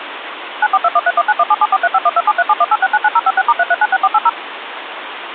DTMF, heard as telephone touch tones, dialled by machine, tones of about 40 ms, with phone line noise. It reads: 94213191774351273718699056*3396480